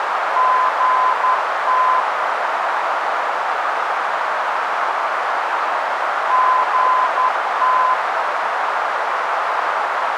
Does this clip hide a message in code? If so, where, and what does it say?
Yes: Morse code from 0.3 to 8.0 s, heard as a keyed tone, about 11 wpm, 1020 Hz, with heavy radio static and a narrow filter. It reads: GT GT